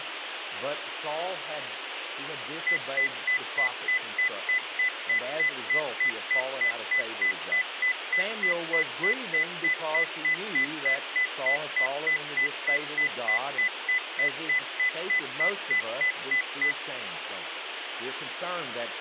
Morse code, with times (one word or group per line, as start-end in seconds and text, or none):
none